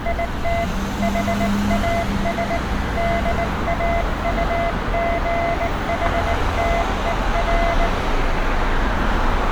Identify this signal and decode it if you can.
Morse code, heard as a keyed tone, hand-sent with a bug key, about 19 wpm, 680 Hz, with street noise. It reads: IT HAS DAUGHTER